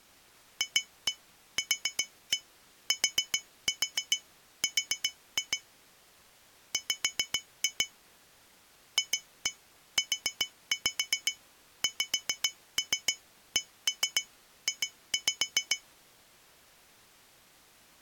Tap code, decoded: FQTR W FUXCJ

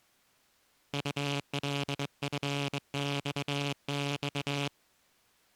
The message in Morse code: ULFXX

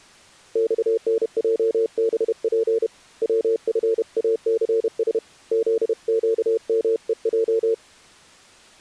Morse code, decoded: XNJBP WFACS ZQMEJ

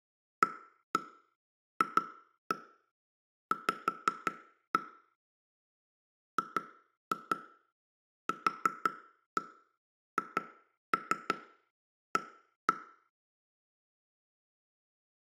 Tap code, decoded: AFV GQHA

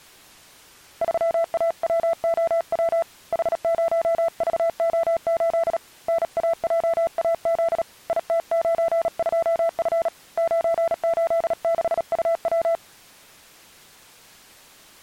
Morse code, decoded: 3AWOW H0VO8 NAJAZ IT92F 986UW

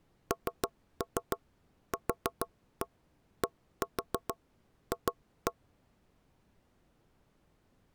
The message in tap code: NQDF

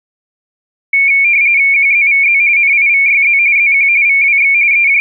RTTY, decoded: QZVZ NIVYZ ZQ VWX …

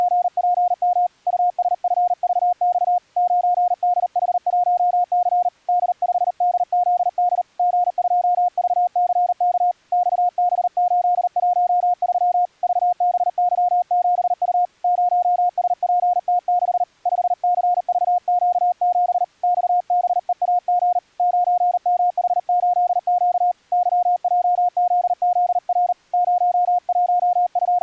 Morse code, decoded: … USFVX 9DH1C D5DZD G2VCK XB813 VBY7U 0SPT6 5CVQ7 XBEAG 9MH8Q YJZZR …

